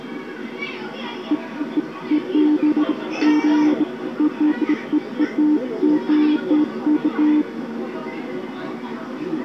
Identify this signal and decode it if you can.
Beeps of irregular length, with the noise of a park. There is no code.